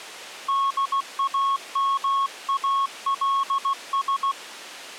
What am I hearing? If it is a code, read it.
Morse code, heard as a keyed tone, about 16 wpm, 1100 Hz. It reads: DAMALS